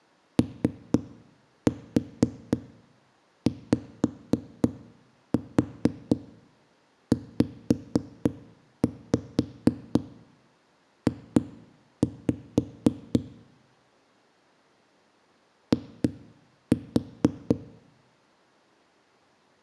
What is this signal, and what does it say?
Tap code, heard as knocks on a wall, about 4 knocks a second, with room echo. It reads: OYZJ I